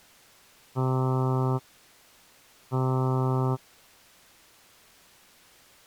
Ship horn signal, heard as a ship's horn, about 130 Hz. 2 short. At sea: I am altering course to port.